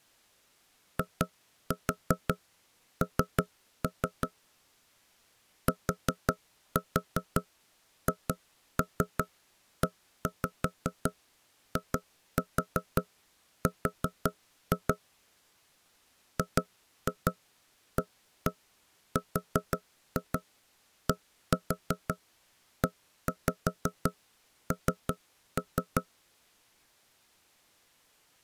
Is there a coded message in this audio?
Yes: tap code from 1.0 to 26.1 s, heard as knocks on wood, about 5 knocks a second. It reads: IN THEIR GARDEN